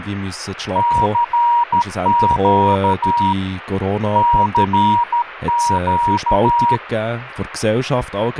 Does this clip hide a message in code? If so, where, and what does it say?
Yes: Morse code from 0.7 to 6.8 s, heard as a keyed tone, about 13 wpm, 950 Hz, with radio static and speech in German. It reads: CQ CQ